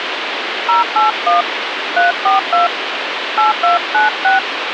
DTMF, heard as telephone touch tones, dialled by hand, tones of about 140 ms, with phone line noise. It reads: 081 342 8296